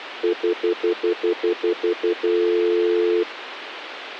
Telephone call progress tone (North American plan), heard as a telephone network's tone, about 350, 440 Hz, 0.1 s on and 0.1 s off, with phone line noise. Stutter dial tone.